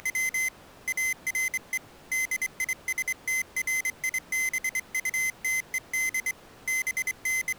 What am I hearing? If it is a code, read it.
Morse code, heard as a high beeper, hand-sent with a straight key, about 24 wpm, 2050 Hz. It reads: … ARE DISTRIBUTED …